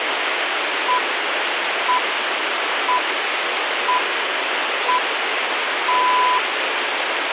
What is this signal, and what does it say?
Radio time signal (six pips, as the Greenwich Time Signal), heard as pips, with radio static.